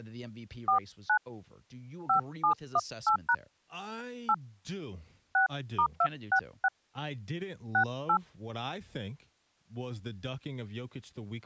DTMF, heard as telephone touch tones, dialled by hand, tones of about 80 ms, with speech in English. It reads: 49 5718# 8 6*266 68